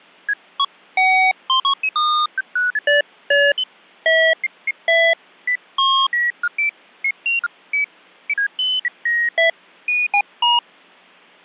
Electronic bleeps of random pitch and length. There is no code.